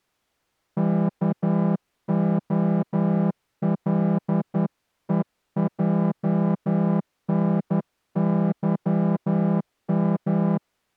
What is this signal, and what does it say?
Morse code, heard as a horn, hand-sent with a straight key, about 11 wpm. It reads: KOLEJNYM